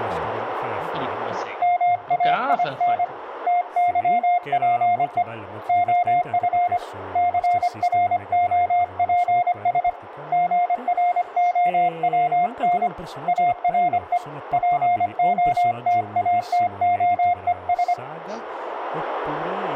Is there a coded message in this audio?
Yes: Morse code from 1.6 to 18.0 s, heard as a keyed tone, hand-sent with a paddle, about 25 wpm, 710 Hz, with radio static, room echo and speech in Italian. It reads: MAIN TYPE OF CROPS GROWN ARE POTATOES